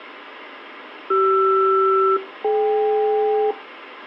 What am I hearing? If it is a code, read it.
Aircraft SELCAL, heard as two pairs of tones, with radio hiss. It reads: CR-DK